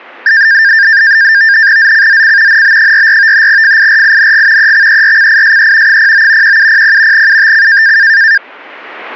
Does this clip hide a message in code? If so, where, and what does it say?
Yes: NAVTEX (SITOR-B), 100 baud, 170 Hz shift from 0.3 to 8.4 s, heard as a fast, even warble, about 1700 Hz centre. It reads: ZCZC NB44 FIRING EXERCISE 09 1700 UTC